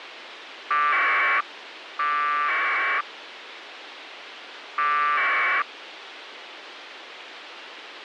Packet radio (AX.25, as in APRS), 1200 baud, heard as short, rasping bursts, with radio hiss.